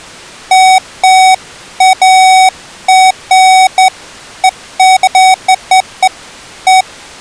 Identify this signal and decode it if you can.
Beeps of irregular length. There is no code.